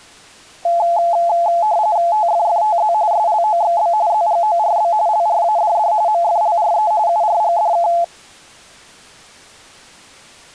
RTTY (45.45 baud, 170 Hz shift), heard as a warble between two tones, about 770 Hz centre. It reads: TFFTZ SLOXB ZGORB LRADD MFLRE URGDK